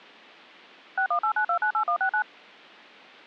DTMF, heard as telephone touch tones, dialled by machine, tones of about 90 ms. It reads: 6189298169